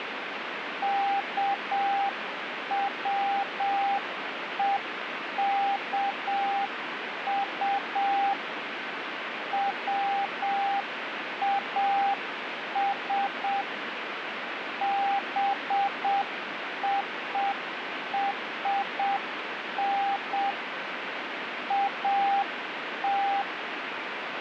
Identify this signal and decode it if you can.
Morse code (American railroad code), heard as a keyed tone, machine-sent, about 800 Hz, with radio static. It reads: KWEKU WAS BORN AT